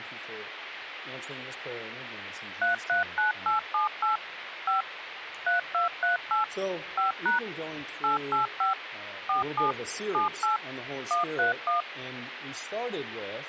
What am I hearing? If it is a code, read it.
DTMF, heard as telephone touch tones, dialled by machine, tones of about 130 ms, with phone line noise. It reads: 339878 5 3238 5# 885 47 78 131